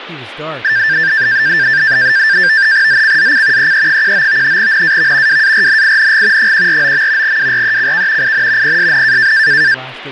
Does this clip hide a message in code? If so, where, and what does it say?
Yes: NAVTEX (SITOR-B), 100 baud, 170 Hz shift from 0.6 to 9.7 s, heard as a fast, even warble, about 1700 Hz centre, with speech in English. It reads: ZCZC EE19 NAV WARNING 149. WRECK IN PSN